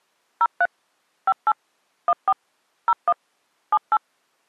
DTMF, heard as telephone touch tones, dialled by machine, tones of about 50 ms. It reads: 03 58 14 01 78